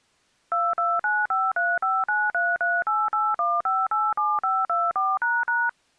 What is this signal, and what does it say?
DTMF, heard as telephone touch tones, dialled by machine, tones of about 220 ms. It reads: 229535933881587524##